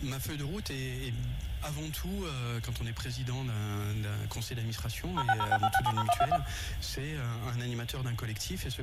DTMF, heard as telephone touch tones, dialled by machine, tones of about 50 ms. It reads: 06065670121